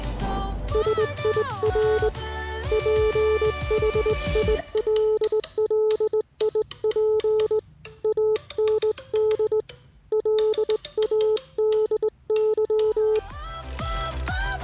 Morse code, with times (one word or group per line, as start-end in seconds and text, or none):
0.7-2.1 SIR
2.7-7.6 PHILLIP
8.0-9.6 AND
10.1-13.2 LADY